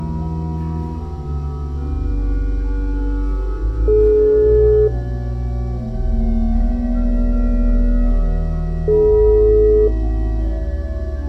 Telephone call progress tone (single-tone plan, as in most of Europe), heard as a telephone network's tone, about 420 Hz, 1 s on and 4 s off. Ringback tone.